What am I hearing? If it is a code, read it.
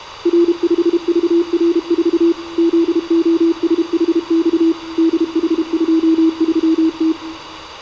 Morse code, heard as a keyed tone, machine-sent, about 32 wpm, 330 Hz. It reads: R5VR4 ZOSHX DH23T